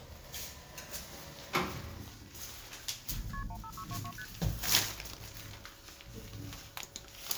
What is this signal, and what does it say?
Multi-frequency trunk signalling (R1, as on North American trunks), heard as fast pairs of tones, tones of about 70 ms, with the noise inside a lift. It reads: KP 15622 ST